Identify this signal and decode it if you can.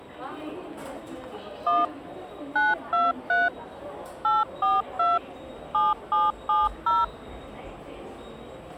DTMF, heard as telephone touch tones, dialled by machine, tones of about 190 ms, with the noise of a subway station. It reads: 1 923 842 7770